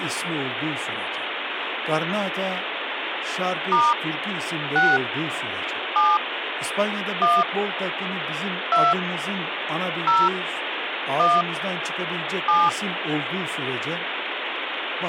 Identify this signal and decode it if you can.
DTMF, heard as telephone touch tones, dialled by hand, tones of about 210 ms, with phone line noise and speech in Turkish. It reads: * 6 7 1 2 0 1 7